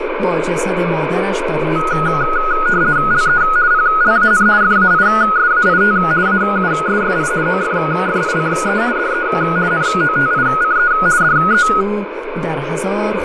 RTTY (50 baud, 170 Hz shift), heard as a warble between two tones, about 1360 Hz centre, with radio static. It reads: LE PLAN FAISAIT AUSSI OFFICE DE NOTICE DE